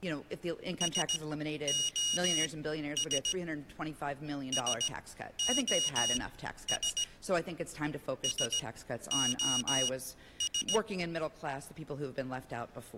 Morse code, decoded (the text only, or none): SOS SOS SOS